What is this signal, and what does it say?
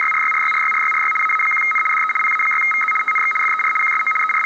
RTTY (75 baud, 850 Hz shift), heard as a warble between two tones, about 1700 Hz centre, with room echo and the noise inside a bus. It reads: … AA1N DE PA6VZ TNX FER QSO …